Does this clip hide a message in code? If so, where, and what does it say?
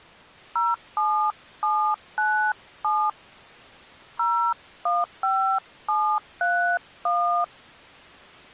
Yes: DTMF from 0.6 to 7.4 s, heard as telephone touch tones, dialled by hand, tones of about 300 ms. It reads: 07797 015731